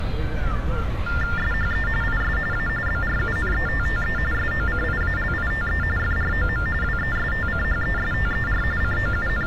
TTY/TDD text telephone tones (45.45 baud Baudot), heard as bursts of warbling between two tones, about 400 Hz shift, 1600 Hz centre, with street noise. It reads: SHE IS A BRUNETTE SOCIALITE FROM WESTCHESTER …